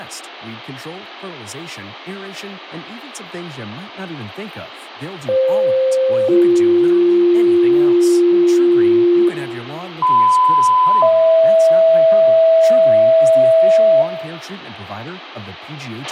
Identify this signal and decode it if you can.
Two-tone page, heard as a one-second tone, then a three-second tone, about 520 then 350 Hz, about 1010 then 650 Hz, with radio hiss, a squelch burst at the end, room echo and speech in English.